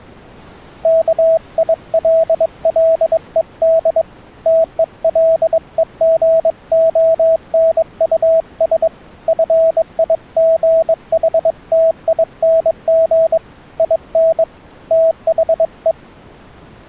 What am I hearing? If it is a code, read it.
Morse code, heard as a keyed tone, hand-sent with a bug key, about 22 wpm, 650 Hz. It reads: KILLED TELEGONUS FIGHTING IN THE